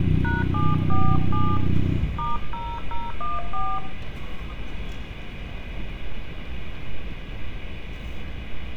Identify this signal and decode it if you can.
DTMF, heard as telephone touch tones, dialled by hand, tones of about 190 ms, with room echo and street noise. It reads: #747 *0014